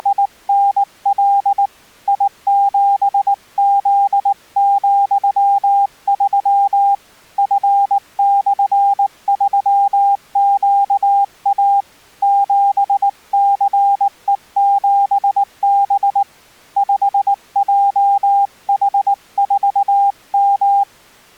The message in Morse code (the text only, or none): … I7Z,3 F/3QA 7CE7B 5JH4M